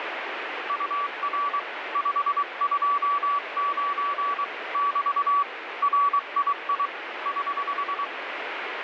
Morse code, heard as a keyed tone, hand-sent with a paddle, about 23 wpm, 1140 Hz, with radio static. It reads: UR 529 <BT> RII <HH>